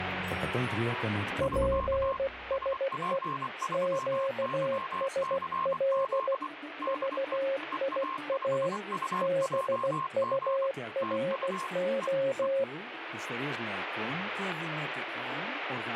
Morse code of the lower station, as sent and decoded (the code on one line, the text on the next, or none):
.--. ... . / --.- ... .-.. / ...- .. .- / -... ..- .-. ---
PSE QSL VIA BURO